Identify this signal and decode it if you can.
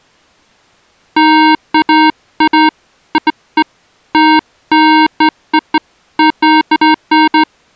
Beeps of irregular length. There is no code.